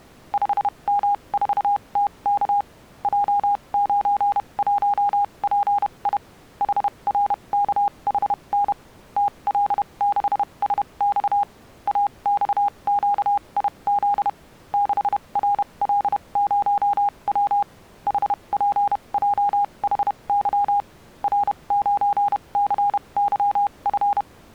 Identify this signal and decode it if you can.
Morse code, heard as a keyed tone, machine-sent, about 31 wpm, spaced as for 25 wpm, 810 Hz. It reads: 5M4TK J91PI HRKHN TL6SX AXQIZ 6RL0W HPJHY R9CYF